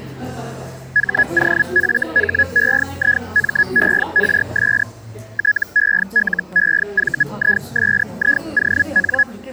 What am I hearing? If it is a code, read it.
Hellschreiber (Feld-Hell, 122.5 baud), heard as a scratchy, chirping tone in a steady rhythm, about 1700 Hz, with the noise of a cafe. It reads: HOFHEIMERS TELEVISION